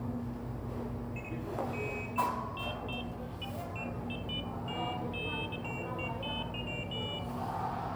Pairs of high tones at irregular times, with room echo and the noise of a cafe. There is no code.